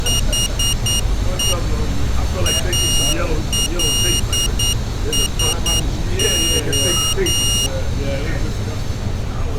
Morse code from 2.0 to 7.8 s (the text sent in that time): ALSO